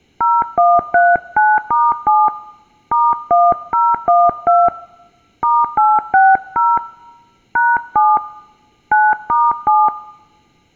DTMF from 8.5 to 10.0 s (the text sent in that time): 9*7